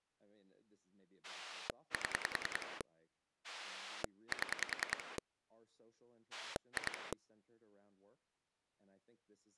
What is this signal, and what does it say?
Pulse dialling, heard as a rotary dial, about 10 pulses a second, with speech in English. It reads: 7 7 2